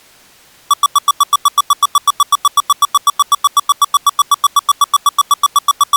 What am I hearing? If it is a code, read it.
Evenly repeated beeps. There is no code.